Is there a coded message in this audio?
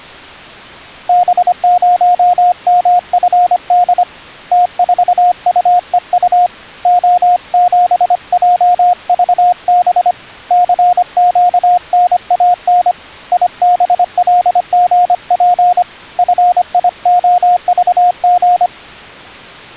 Yes: Morse code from 1.0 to 18.7 s, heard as a keyed tone, hand-sent with a paddle, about 25 wpm, 710 Hz. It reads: B0MFD T4UEU O7JVB CQNAN IBLGP FIOVG